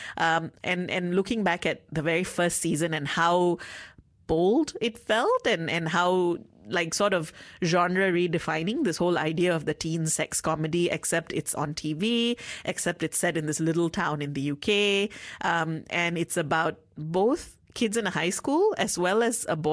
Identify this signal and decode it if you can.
Speech in English. There is no code.